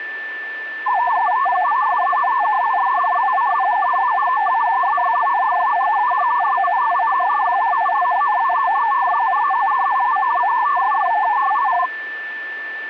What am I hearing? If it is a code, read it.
Multi-tone FSK (Olivia or MFSK type), about 500 Hz wide, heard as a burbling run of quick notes, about 62.5 baud, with a steady whistle near 1770 Hz.